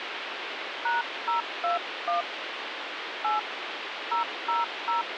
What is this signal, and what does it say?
DTMF, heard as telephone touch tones, dialled by hand, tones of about 140 ms, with phone line noise. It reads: #021 8 000